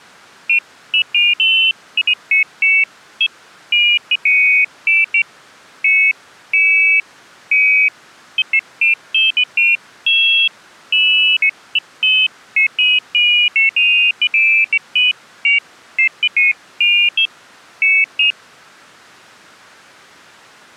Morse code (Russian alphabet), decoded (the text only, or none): none